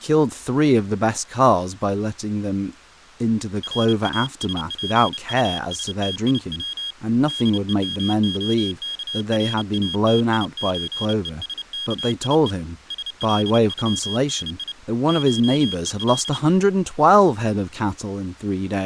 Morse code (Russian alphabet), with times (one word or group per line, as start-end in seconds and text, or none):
3.6-6.9 РАСПУСТИВ
7.3-12.5 ДЕМОКРАТИЧЕСКИЕ
12.9-14.7 СЛЮНИ
15.1-16.4 ШЕЛ